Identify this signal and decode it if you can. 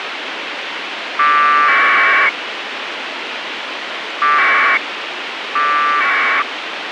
Packet radio (AX.25, as in APRS), 1200 baud, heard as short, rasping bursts, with radio hiss.